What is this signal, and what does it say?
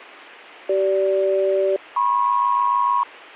Aircraft SELCAL, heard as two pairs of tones, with a squelch burst at the end. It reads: CG-MP